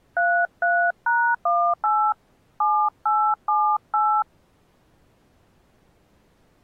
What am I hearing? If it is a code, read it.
DTMF, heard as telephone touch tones, dialled by hand, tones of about 290 ms. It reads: 33#18 7878